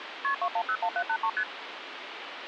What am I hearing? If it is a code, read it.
Multi-frequency trunk signalling (R1, as on North American trunks), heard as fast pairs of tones, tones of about 70 ms, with phone line noise. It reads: KP 2101783 ST